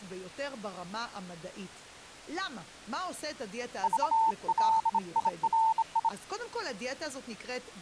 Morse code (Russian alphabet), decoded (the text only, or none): ЖЛИРИ